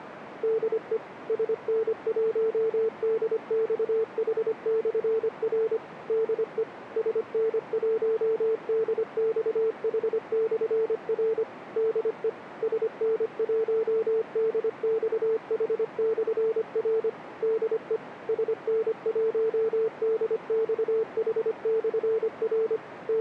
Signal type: Morse code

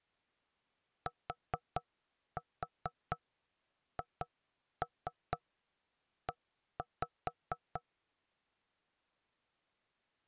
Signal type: tap code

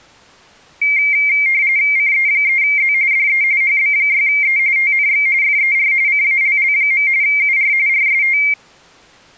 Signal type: RTTY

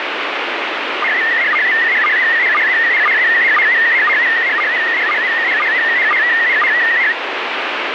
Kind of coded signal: SSTV (slow-scan television)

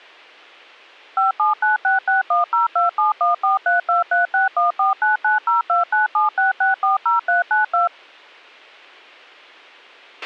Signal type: DTMF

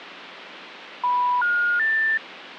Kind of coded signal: telephone call progress tone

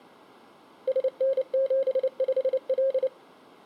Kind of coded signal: Morse code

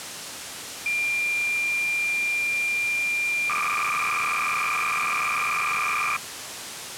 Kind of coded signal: cassette data (Kansas City type)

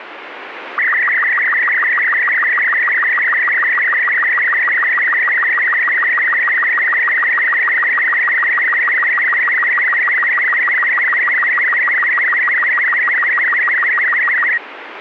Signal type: SSTV (slow-scan television)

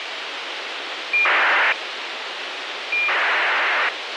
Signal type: ACARS aircraft data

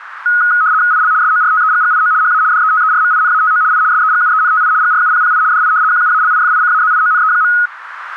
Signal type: RTTY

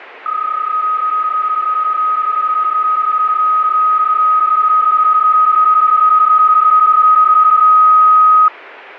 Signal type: PSK31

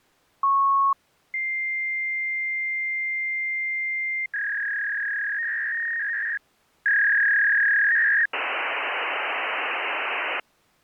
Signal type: fax machine handshake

